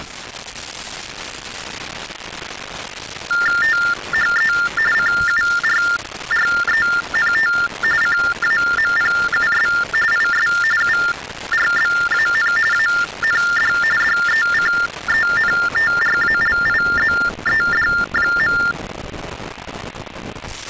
TTY/TDD text telephone tones (45.45 baud Baudot), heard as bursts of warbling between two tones, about 400 Hz shift, 1600 Hz centre. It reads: THE CURRENT CAMPUS IS URBAN AND DECENTRALIZED.